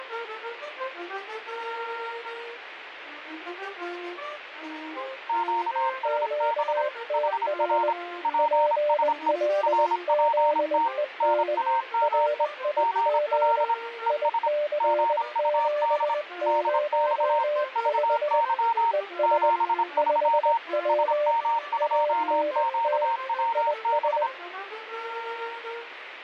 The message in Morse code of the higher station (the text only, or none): QSB HR PSE RPT NAME GL ES GUD DX VY 73 SM2QWB